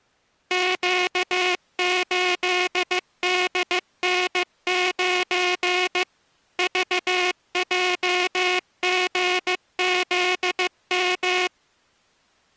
Morse code, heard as a buzzer, machine-sent, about 15 wpm. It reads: Q8DN9 VJGZM